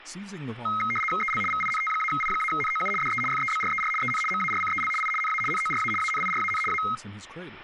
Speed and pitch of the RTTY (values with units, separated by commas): 75 baud, 850 Hz shift, 1700 Hz centre